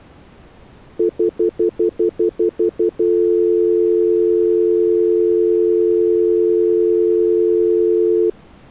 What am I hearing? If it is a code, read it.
Telephone call progress tone (North American plan), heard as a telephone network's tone, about 350, 440 Hz, 0.1 s on and 0.1 s off. Stutter dial tone.